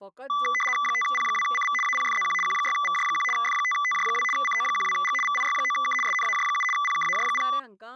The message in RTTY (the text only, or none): 5P2CV APFZQ Q6VJ1 F5TJ2 CO12G VIY9K SNAJ7 PKAJ0